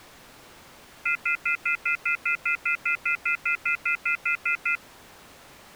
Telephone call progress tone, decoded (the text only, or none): off-hook warning tone